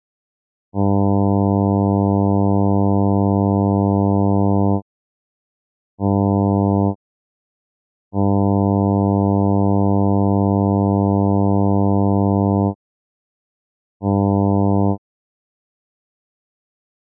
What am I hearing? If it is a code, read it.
Ship horn signal, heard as a ship's horn, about 100 Hz. 1 long, 1 short, 1 long, 1 short. At sea: I agree to be overtaken.